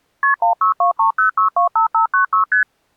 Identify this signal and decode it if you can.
Multi-frequency trunk signalling (R1, as on North American trunks), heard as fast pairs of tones, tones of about 110 ms. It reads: KP 16230625596 ST